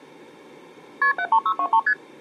Multi-frequency trunk signalling (R1, as on North American trunks), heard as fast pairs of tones, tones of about 70 ms. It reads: KP 73623 ST